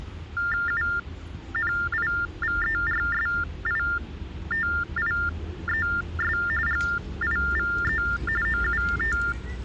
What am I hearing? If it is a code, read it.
TTY/TDD text telephone tones (45.45 baud Baudot), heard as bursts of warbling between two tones, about 400 Hz shift, 1600 Hz centre, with hum and the noise of a residential street. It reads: UNIVERSITIES GIVE OUT